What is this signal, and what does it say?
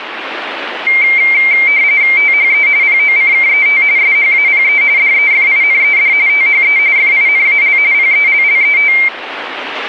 RTTY (45.45 baud, 170 Hz shift), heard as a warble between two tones, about 2200 Hz centre, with radio static. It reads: THE POCKET SHAPE DEFINED THE FINAL PELLET